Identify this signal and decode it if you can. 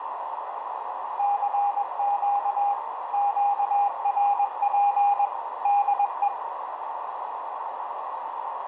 Morse code, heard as a keyed tone, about 21 wpm, 810 Hz, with radio static, a narrow filter and room echo. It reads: CQ QRP DE